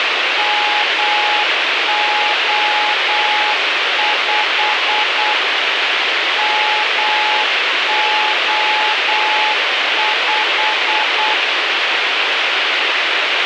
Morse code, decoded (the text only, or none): MO5 MO5